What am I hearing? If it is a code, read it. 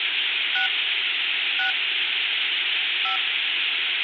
DTMF, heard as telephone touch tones, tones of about 110 ms, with phone line noise. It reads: 6 6 5